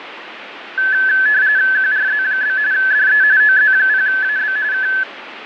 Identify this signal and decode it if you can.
RTTY (45.45 baud, 170 Hz shift), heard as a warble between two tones, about 1600 Hz centre, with radio static. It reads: QRZ? DE OZ0AB K